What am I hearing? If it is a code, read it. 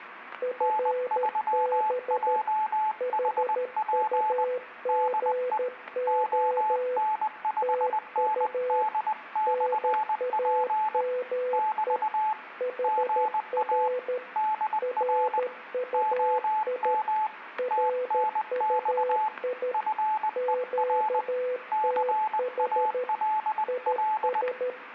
Morse code, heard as two keyed tones, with static crashes and room echo. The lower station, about 13 wpm, 500 Hz: FB HUGO TU NAME HR RUI RUI QTH IS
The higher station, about 20 wpm, 860 Hz: N3JHP DE ON5ND/P <BT> GA DR OM TNX FER CALL